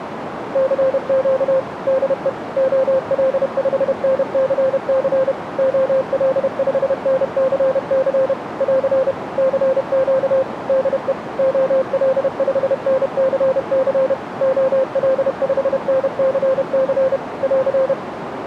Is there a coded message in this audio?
Yes: Morse code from 0.5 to 18.0 s, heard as a keyed tone, machine-sent, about 31 wpm, 530 Hz, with radio static and a narrow filter. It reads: CQ DE OL5NCC OL5NCC <AR> CQ DE OL5NCC OL5NCC <AR>